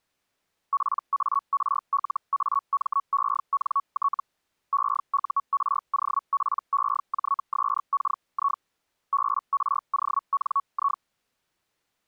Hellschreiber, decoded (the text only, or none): PARLAMENT EUROPEJSKI BRONI